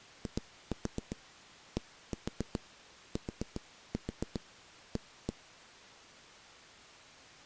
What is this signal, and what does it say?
Tap code, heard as knocks on a wall, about 7 knocks a second. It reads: IDTA